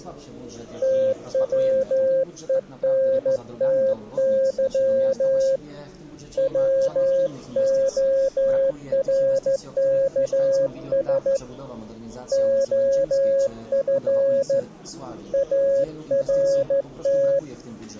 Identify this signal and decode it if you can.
Morse code, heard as a keyed tone, hand-sent with a straight key, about 14 wpm, 540 Hz. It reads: TWENTY WORKS OF ART